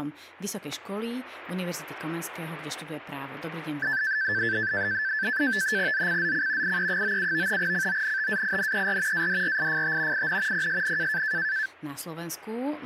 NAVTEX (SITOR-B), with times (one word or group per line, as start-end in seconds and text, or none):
5.9-6.8 ZCZC
6.6-7.6 IE97
7.6-9.3 CONTAINER
9.1-10.3 ADRIFT
10.1-10.7 IN
10.5-11.2 PSN